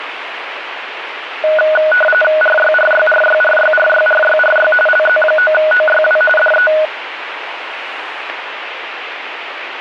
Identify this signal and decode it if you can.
RTTY (45.45 baud, 850 Hz shift), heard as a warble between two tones, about 1050 Hz centre, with radio static and street noise. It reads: RYRYRYRYRYRYRY LZ9OYW DE